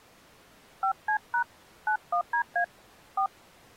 DTMF, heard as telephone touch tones, dialled by hand, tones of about 90 ms. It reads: 5C# 91DA 4